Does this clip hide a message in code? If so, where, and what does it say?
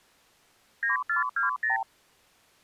Yes: multi-frequency trunk signalling (R2, with the far end's replies) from 0.8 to 1.8 s, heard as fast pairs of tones, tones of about 130 ms. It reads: 9420